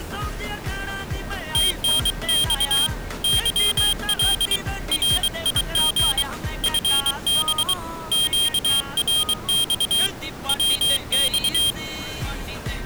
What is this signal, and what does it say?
Morse code, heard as a high beeper, hand-sent with a paddle, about 23 wpm, 3200 Hz. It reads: TNX YL RIG FB QRX WX